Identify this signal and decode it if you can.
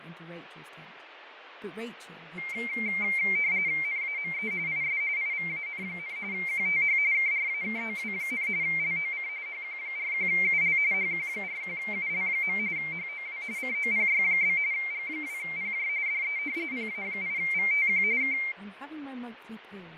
RTTY (45.45 baud, 170 Hz shift), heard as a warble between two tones, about 2200 Hz centre, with radio static, fading and speech in English. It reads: NAME IS IVAN, QTH KRAKOW, LOC HQ41UL HQ41UL. HOW COPY? G2PJ DE PA8VTQ K